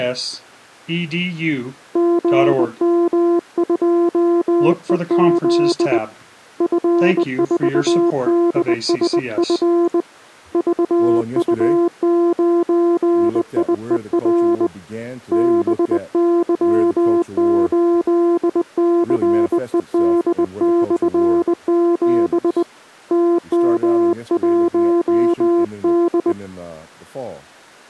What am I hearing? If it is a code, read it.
Morse code, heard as a keyed tone, hand-sent with a bug key, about 20 wpm, 340 Hz. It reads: GM2EZ F4DSF VU9IER BY8CED/7 TM1D